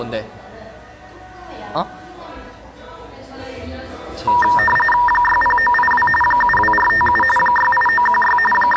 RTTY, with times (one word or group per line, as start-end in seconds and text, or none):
5.1-6.1 60982
6.2-7.2 72457
7.4-8.4 68916
8.5-8.8 …